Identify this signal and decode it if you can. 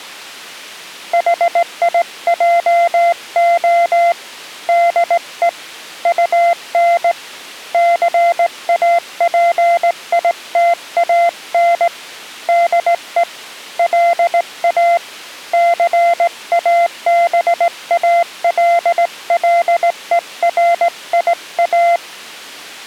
Morse code, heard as a keyed tone, hand-sent with a straight key, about 18 wpm, 690 Hz. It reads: HIJO DE UN CAPITAN DE LA CABALLERIA